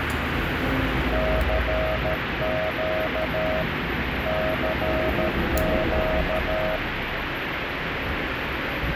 Morse code, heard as a keyed tone, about 13 wpm, 630 Hz, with radio static and street noise. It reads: CQ CQ